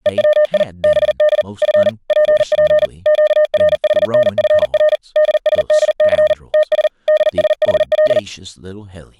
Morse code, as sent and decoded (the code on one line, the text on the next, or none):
. .-- .. / -... -.. / ..-. / .--. .--. / --.- .-. .... -. ..-. .-. / -.. ... -.. -.-. / - ... / -.. ... .... .-..
EWI BD F PP QRHNFR DSDC TS DSHL